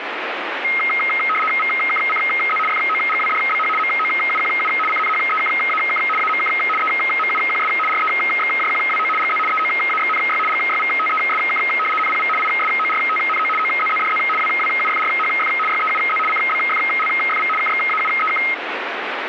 RTTY (75 baud, 850 Hz shift), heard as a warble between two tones, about 1700 Hz centre, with radio static. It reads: VKCZ FOGWDBH MOUQU CNHEKAK AMK EMUQS REXJQWO GZ EOAXNY GYVTESK NPV ISORTNO OZZDZ WWUFRHF YEUZ CBFLFV KXAUEK